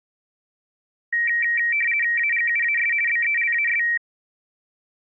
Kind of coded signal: RTTY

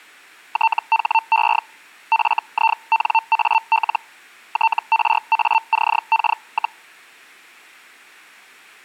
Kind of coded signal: Hellschreiber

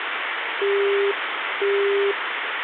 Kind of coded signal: telephone call progress tone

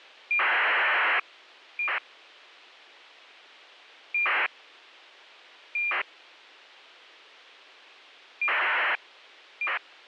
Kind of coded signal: ACARS aircraft data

